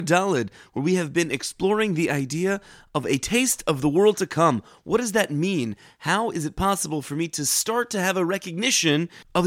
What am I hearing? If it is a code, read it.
Speech in English. There is no code.